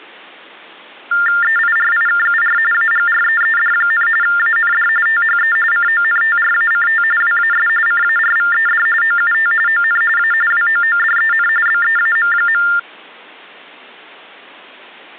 TTY/TDD text telephone tones (45.45 baud Baudot), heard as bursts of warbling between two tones, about 400 Hz shift, 1600 Hz centre. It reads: EIRIKUR AGREED, AND THE CONTRACT WAS CARVED OUT ON A WOODEN BEAM.